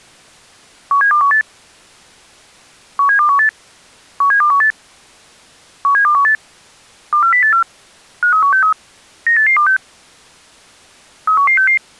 Five-tone selective call (CCIR), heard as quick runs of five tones, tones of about 100 ms. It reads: 17218 17218 17218 17218 24084 53163 98826 31166